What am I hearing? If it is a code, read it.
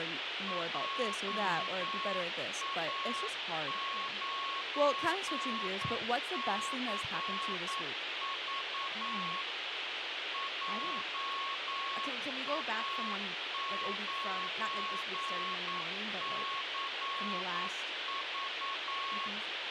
Morse code, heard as a keyed tone, machine-sent, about 9 wpm, 1100 Hz, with radio hiss, a squelch burst at the end and speech in English. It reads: JA9CV JA9CV